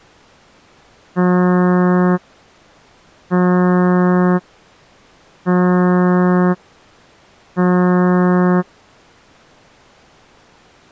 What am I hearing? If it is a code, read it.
Ship horn signal, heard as a ship's horn, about 180 Hz. 4 short. At sea: a pilot vessel's identity signal in fog.